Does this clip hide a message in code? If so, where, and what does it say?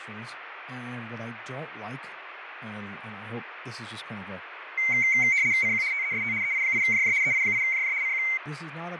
Yes: RTTY (75 baud, 170 Hz shift) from 4.8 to 8.4 s, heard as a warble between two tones, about 2150 Hz centre, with radio static, fading and speech in English. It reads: CQ TEST EI8JJ EI8JJ CQ